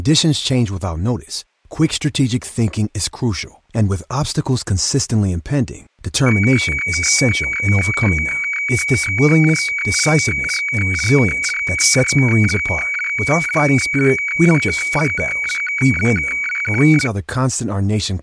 Weather fax (radiofax), 120 lines a minute, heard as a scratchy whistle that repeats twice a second, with speech in English.